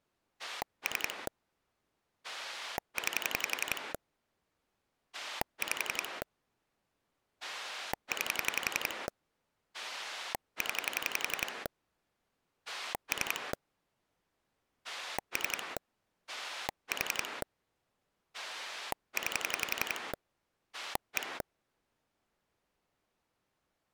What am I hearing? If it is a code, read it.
Pulse dialling, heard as a rotary dial, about 11 pulses a second. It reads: 3 9 5 9 0 3 3 4 9 1